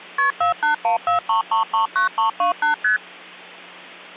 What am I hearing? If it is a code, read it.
Multi-frequency trunk signalling (R1, as on North American trunks), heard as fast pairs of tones, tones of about 120 ms, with hum. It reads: KP 48143339328 ST